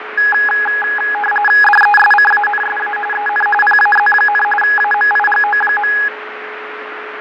RTTY (45.45 baud, 850 Hz shift), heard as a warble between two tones, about 1250 Hz centre, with radio static, fading and a steady whistle near 430 Hz. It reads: DESCANSA EN PAZ, AMIGO.